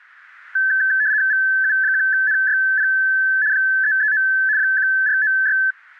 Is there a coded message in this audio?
Yes: RTTY (75 baud, 170 Hz shift) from 0.6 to 5.7 s, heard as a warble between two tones, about 1650 Hz centre. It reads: VU1NYP 339 1496